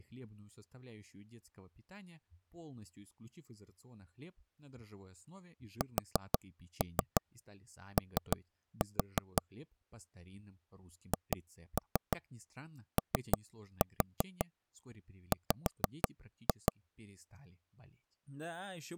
Tap code, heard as taps on a table, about 6 knocks a second, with speech in Russian. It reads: SO HOW